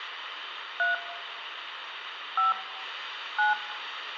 DTMF, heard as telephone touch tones, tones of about 150 ms, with phone line noise. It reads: 3 5 9